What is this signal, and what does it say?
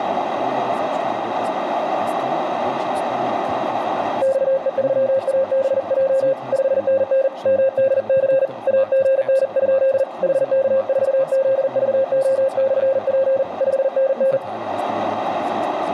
Morse code, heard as a keyed tone, hand-sent with a paddle, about 40 wpm, 530 Hz, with radio static and speech in German. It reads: XE3ABJ 5NN MDC AGN? HK4ZVO/P 5NN